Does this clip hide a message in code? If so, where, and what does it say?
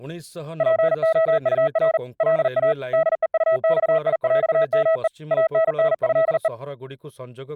Yes: Morse code (with French letters) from 0.5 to 6.5 s, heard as a keyed tone, hand-sent with a paddle, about 40 wpm, 650 Hz, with speech in Odia. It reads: POUR LA DEUXIÈME ANNÉE